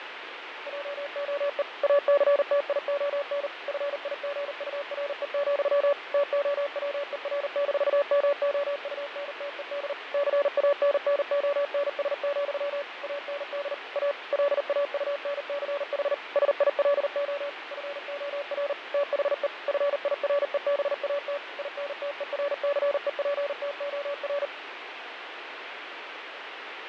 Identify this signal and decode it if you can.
Morse code, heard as a keyed tone, machine-sent, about 39 wpm, 570 Hz, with radio static and fading. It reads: JOE ACTION FIGURE, TOWER-MOUNTED CANNONS, AND A LAUNCH SILO FOR THE FIREBAT INTERCEPTOR